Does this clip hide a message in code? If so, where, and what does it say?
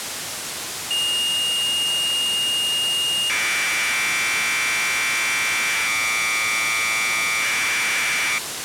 Yes: Commodore tape loading (standard loader) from 0.9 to 8.4 s, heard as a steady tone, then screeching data, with tape hiss.